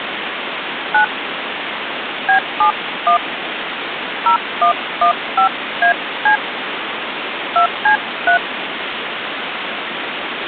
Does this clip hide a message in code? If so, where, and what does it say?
Yes: DTMF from 0.9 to 8.4 s, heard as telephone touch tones, dialled by hand, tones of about 100 ms, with phone line noise. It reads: 9 B71 0115AC 2C3